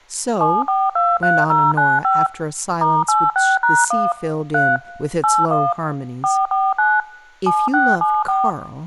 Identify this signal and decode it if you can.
DTMF, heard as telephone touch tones, dialled by machine, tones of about 220 ms, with speech in English. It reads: 7423095 *86#1 3 81 449 7674